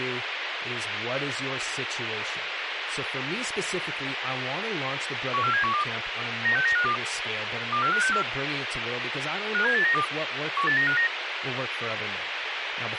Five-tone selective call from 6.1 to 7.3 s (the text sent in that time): 96952